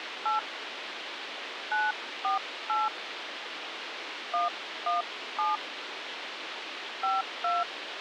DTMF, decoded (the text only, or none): 8 948 117 52